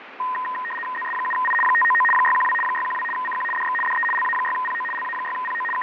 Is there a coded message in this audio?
Yes: RTTY (75 baud, 850 Hz shift) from 0.2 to 5.8 s, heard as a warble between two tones, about 1440 Hz centre, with radio static and fading. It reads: ZS7I 599 612 612 CQ DX DE LA6PO LA6PO …